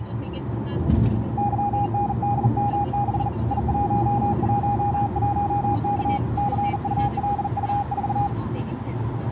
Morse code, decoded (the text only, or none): YNDM6 I111K CULU4